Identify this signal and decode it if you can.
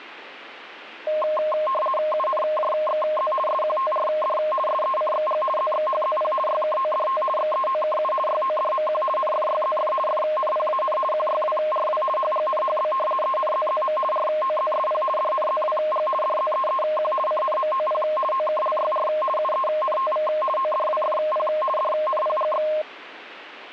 RTTY (50 baud, 450 Hz shift), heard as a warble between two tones, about 840 Hz centre. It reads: UNJXZ SQTRD SECXG ZXHZP YKODT XEOKU YODMQ NFYZF FNPAN QYWRW HGNHB ENZZM ROZSP DNZWG DZEEQ CNMOP OKLYR UENTV ODWFP DNPGX